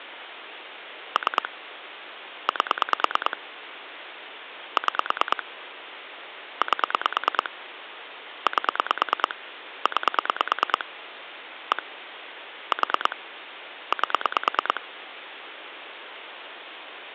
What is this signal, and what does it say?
Pulse dialling, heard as clicks on a phone line, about 9 pulses a second, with phone line noise. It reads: 3 8 6 8 8 9 1 4 8